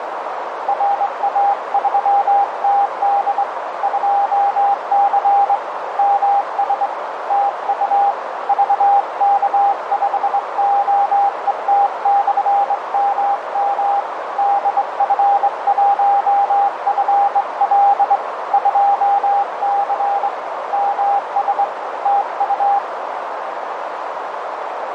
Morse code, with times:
0.7-3.4 RA3TD
3.8-5.6 2C
6.0-6.9 MS
7.3-8.1 TU
8.5-14.0 VK5OET/MM
14.4-18.2 DF1FL
18.5-20.3 2C
20.7-21.6 MS
22.1-22.8 TU

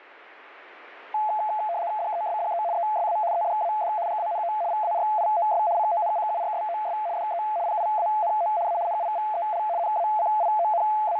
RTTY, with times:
2.0-2.6 DESDE
2.7-3.2 ESA
3.3-3.9 EDAD
4.1-4.5 GANO
4.7-5.6 VARIOS
5.8-7.0 CONCURSOS
7.2-7.4 DE
7.7-8.5 PIANO
8.7-8.8 A
8.9-9.6 NIVEL
9.8-11.2 …

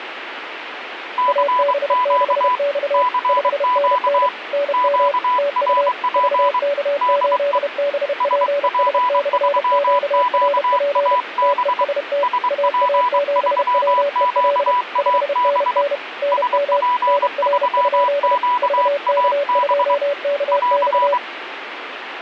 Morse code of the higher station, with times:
1.2-2.6 CQ
2.9-4.3 CQ
4.7-6.6 QRP
7.0-7.6 DE
8.2-11.8 SP3QAB
12.2-15.8 SP3QAB
16.3-19.9 SP3QAB
20.5-21.2 <AR>

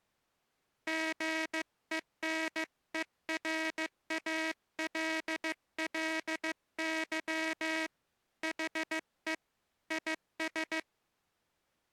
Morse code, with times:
0.9-7.9 GENERALLY
8.4-9.3 HE
9.9-10.8 IS

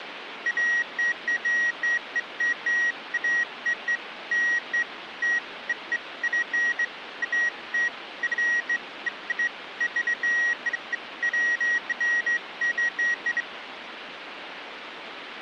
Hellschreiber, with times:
none

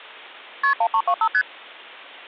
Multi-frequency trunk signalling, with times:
0.6-0.7 KP
0.8-1.3 1325
1.3-1.4 ST

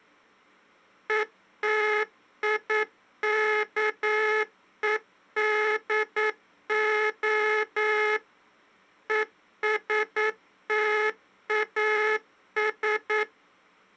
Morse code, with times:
1.1-8.2 ETIKEDO
9.1-13.2 ESTAS

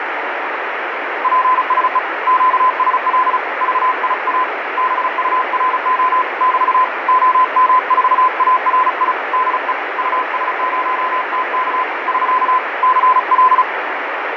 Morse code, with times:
1.2-2.0 PSE
2.3-3.4 QSL
3.6-4.4 VIA
4.8-6.2 BURO
6.4-6.8 <BT>
7.1-9.1 OM4ARI
9.3-9.7 DE
10.0-11.8 US0TK
12.1-12.6 <SK>
12.8-13.6 CL

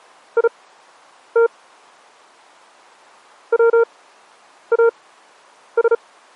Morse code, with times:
0.4-1.5 IT
3.5-5.9 WAS

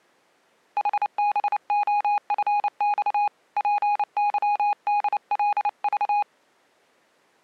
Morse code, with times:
0.8-3.3 HBOFX
3.6-6.2 PYDLV

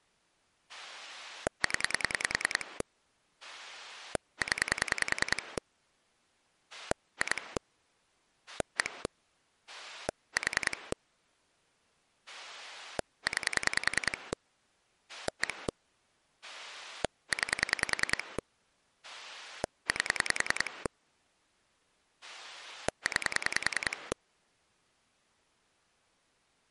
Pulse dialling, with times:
0.7-2.8 0
3.4-5.6 0
6.7-7.6 2
8.5-9.1 1
9.7-10.9 4
12.3-14.3 9
15.1-15.7 1
16.4-18.4 9
19.0-20.9 8
22.2-24.1 9

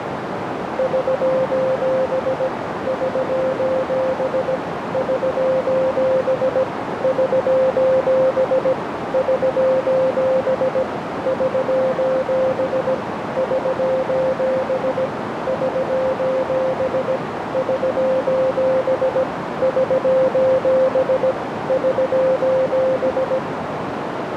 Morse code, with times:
0.8-2.5 <SOS>
2.9-4.6 <SOS>
4.9-6.6 <SOS>
7.0-8.7 <SOS>
9.1-10.8 <SOS>
11.3-12.9 <SOS>
13.4-15.1 <SOS>
15.5-17.2 <SOS>
17.5-19.2 <SOS>
19.6-21.3 <SOS>
21.7-23.4 <SOS>

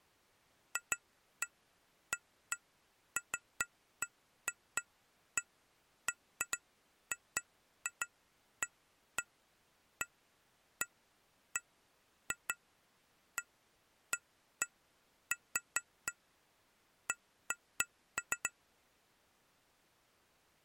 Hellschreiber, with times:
none

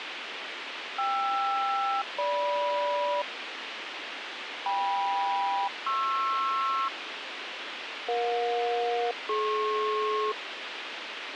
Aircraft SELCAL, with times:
1.0-3.2 KR-GM
4.7-6.9 KM-PR
8.1-10.3 EJ-DP

